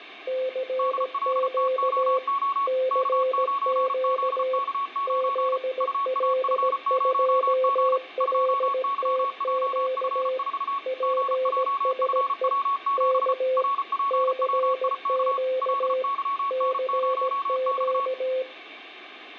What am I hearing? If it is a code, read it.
Morse code, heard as two keyed tones, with radio static and room echo. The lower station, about 17 wpm, 520 Hz: CQ CQ ZL2LTQ PSE K CQ CQ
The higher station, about 34 wpm, 1110 Hz: DLTOO K9ZK9 UAF0G 2YJF4 GJFW7 RPWIK LYN0X